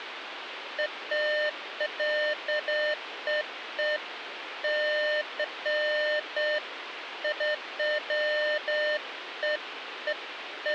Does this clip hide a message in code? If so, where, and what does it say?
No, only beeps of irregular length, with phone line noise.